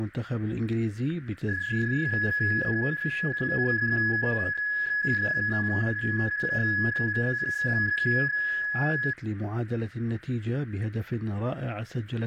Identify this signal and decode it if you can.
PSK31 (31.25 baud), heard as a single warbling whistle, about 1700 Hz, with radio static and static crashes.